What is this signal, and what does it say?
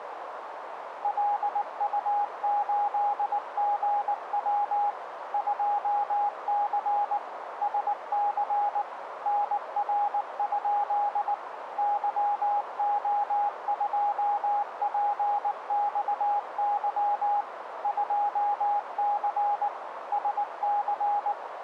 Morse code, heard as a keyed tone, machine-sent, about 19 wpm, 820 Hz, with radio static and a narrow filter. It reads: LU8GW 2C SC NR? YO2PXY 2C SC